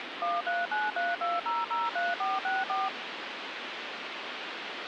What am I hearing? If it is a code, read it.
DTMF, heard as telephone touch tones, dialled by machine, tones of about 190 ms, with phone line noise. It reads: 13932003464